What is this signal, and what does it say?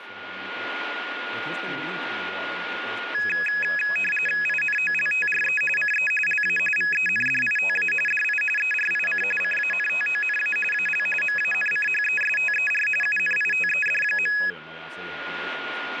RTTY (45.45 baud, 850 Hz shift), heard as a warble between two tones, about 2100 Hz centre, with radio static, a steady whistle near 1430 Hz and speech in Finnish. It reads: INOLTRE CE LA VENDITA DI ERIC CANTONA AL MANCHESTER UNITED.